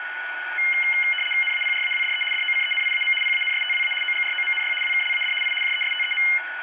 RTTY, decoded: NAPRAWDE DOCENIAM PANSTWA OGROMNY WKLAD I JESTEM

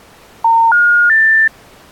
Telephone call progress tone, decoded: special information tone

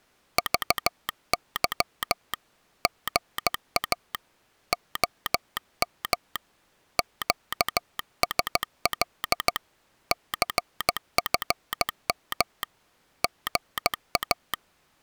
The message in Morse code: VY GA OM QSL CFM GA

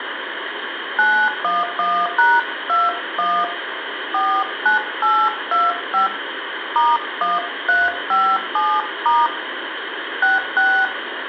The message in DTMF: 911#21 49825 *1357* 66

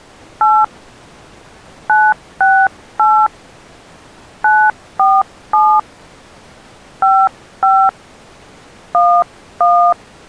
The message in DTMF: 8 968 947 55 11

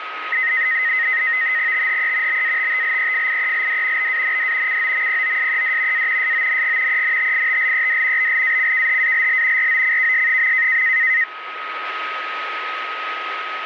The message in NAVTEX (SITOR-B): THE BATTLEFIELD BAND COMPOSED A SONG ENTITLED BLACKHALL ROCKS.

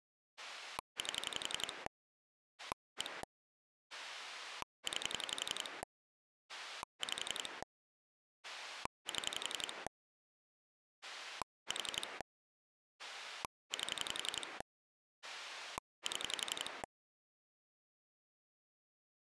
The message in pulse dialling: 8 1 9 5 7 4 8 7

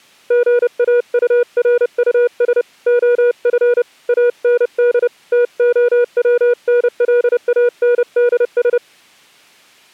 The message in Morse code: GAURUS OF AND TOWNLANDS

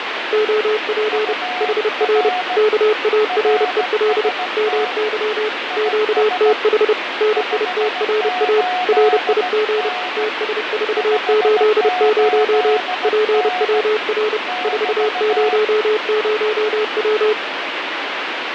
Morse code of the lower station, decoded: OP HR KAREL MY QTH NITRA RIG TS480 PWR 400W

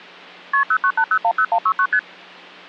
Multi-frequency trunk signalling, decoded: KP 098010169 ST

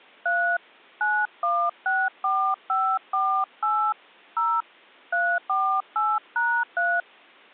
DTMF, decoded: 3 9164548 0 348#3

